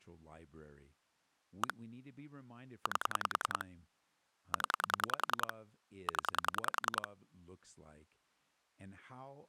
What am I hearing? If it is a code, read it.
Pulse dialling, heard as clicks on a phone line, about 10 pulses a second, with speech in English. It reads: 1 8 0 0